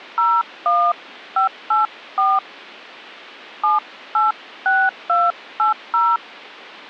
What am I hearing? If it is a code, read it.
DTMF, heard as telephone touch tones, dialled by hand, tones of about 190 ms. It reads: 01584 786280